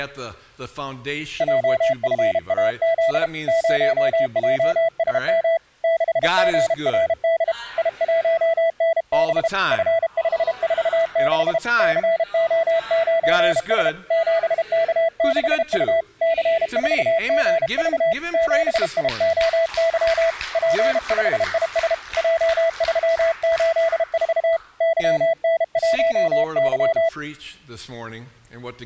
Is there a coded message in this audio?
Yes: Morse code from 1.3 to 27.1 s, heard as a keyed tone, hand-sent with a paddle, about 32 wpm, 660 Hz. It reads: JFAZ 0JSM 6GRD I1NB F546 CO9S 7K6U C4GV 7IOY P5IS J384 YN1Y